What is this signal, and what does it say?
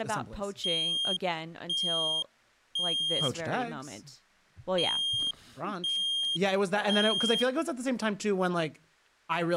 Alarm pattern, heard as an alarm's beeps, played twice, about 3200 Hz, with speech in English. Temporal three. Smoke or fire, evacuate.